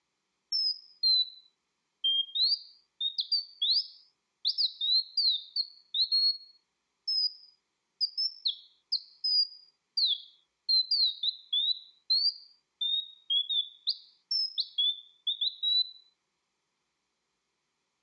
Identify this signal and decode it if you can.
Bird-like chirps, with room echo. There is no code.